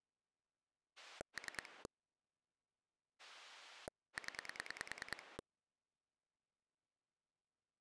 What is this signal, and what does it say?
Pulse dialling, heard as a rotary dial, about 10 pulses a second. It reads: 3 0